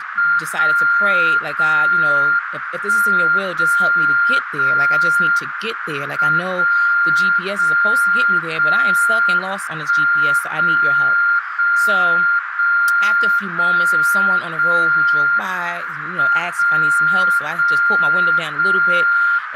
Radio time signal (WWVB), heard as a tone whose level steps once a second, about 1400 Hz, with radio static, a narrow filter and speech in English. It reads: 0 0 1 0 0 M 0 0 0 1 0 0 0 0 0 M 0 0 0